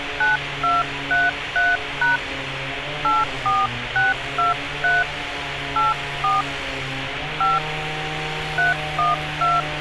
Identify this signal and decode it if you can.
DTMF, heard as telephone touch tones, dialled by hand, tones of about 180 ms, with phone line noise and street noise. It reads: 9233# 84623 84 5 312